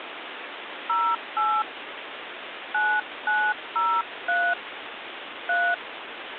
DTMF, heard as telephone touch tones, dialled by hand, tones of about 260 ms, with phone line noise. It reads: 08 9903 3